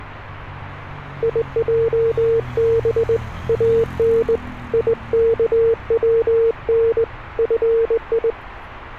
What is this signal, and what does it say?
Morse code (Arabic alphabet), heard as a keyed tone, hand-sent with a straight key, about 20 wpm, 460 Hz, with street noise. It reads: يجب ان يكون في